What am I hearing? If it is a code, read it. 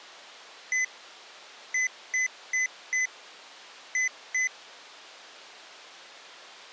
Beep code, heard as beeps from a small speaker, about 2000 Hz. 1-4-2. In Phoenix BIOS tables: parity failure in the first 64 KB of memory.